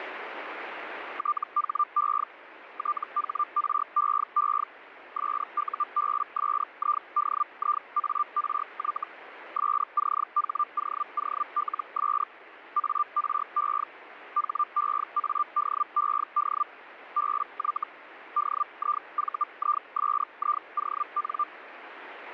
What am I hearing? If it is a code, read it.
Hellschreiber (Feld-Hell, 122.5 baud), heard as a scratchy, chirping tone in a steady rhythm, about 1190 Hz, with radio static. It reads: THE THREE SUBSIDIARY SCHOOLS ARE HEADED BY DIVISION